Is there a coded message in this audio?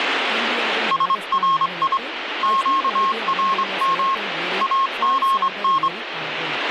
Yes: Morse code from 0.9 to 5.9 s, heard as a keyed tone, hand-sent with a straight key, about 25 wpm, 1080 Hz, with radio static and speech in Tamil. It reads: SRI QRM AGN